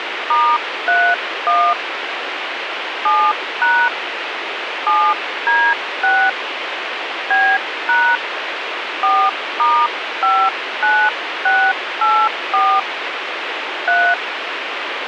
DTMF, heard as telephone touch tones, dialled by hand, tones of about 260 ms, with radio hiss. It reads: *31 7# 7D6 B# 4*59684 3